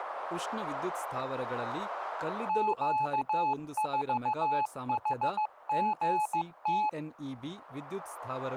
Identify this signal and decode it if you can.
Morse code, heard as a keyed tone, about 15 wpm, 860 Hz, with speech in Kannada. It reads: Q4HGT